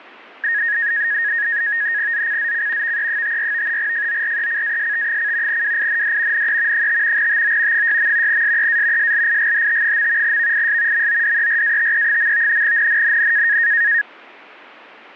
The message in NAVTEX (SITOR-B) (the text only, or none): ZCZC VE54 FORECAST: WIND NE 5 TO 6. SEA SLIGHT. VIS MODERATE. NNNN